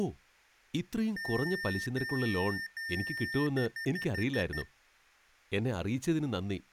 Beep code, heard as beeps from a small speaker, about 1800 Hz, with room echo and speech in Malayalam. 3 long, 6 short.